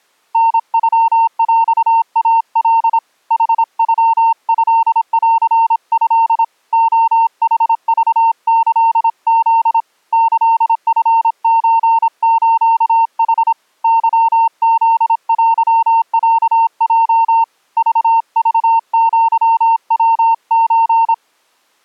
Morse code (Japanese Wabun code), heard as a keyed tone, hand-sent with a paddle, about 26 wpm, 910 Hz. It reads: タノヰイカ ヌノトント レヌクキフ キチソスヌ ケフテロヲ ククアヤソ